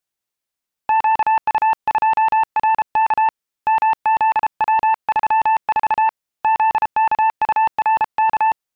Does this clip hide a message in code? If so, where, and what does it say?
Yes: Morse code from 0.8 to 8.6 s, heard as a keyed tone, hand-sent with a paddle, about 33 wpm, 890 Hz. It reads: QU2RK MZW34 ZKURK